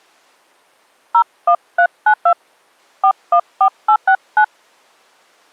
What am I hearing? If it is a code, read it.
DTMF, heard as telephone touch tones, dialled by hand, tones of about 80 ms. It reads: 01392 414869